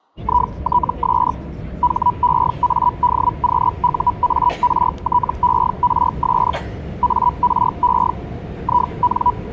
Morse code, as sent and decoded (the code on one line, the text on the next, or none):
none